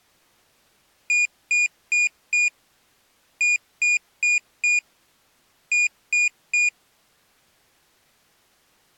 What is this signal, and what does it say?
Beep code, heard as a piezo beeper, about 2450 Hz. 4-4-3. In Phoenix BIOS tables: maths coprocessor failure.